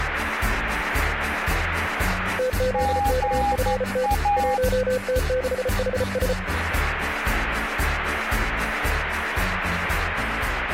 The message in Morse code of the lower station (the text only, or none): TZKFT 1T6HS